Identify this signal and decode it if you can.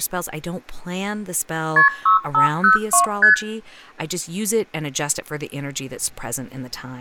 Multi-frequency trunk signalling (R1, as on North American trunks), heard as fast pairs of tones, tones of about 120 ms, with room echo and speech in English. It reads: KP 6502 ST